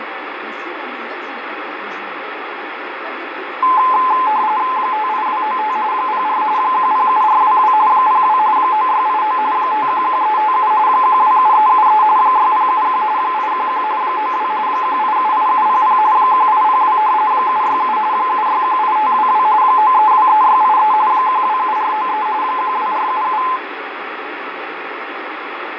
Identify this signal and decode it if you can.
RTTY (45.45 baud, 170 Hz shift), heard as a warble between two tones, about 940 Hz centre, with radio static. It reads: 58295 04 107422 02 9689 511357 127373 6071 811 92 1878700 1802 767 7618522 9323683 127493 12477